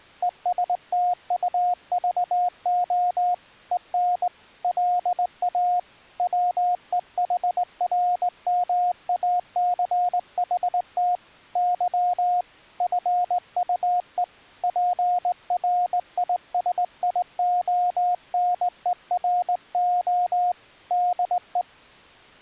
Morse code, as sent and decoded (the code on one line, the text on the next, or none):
. ... - ..- ...- --- / . -. / .-.. .- / .-- . .... .-. -- .- -.-. .... - / -.-- / ..-. ..- . / .--. .-. .. ... .. --- -. . .-. --- / -.. .
ESTUVO EN LA WEHRMACHT Y FUE PRISIONERO DE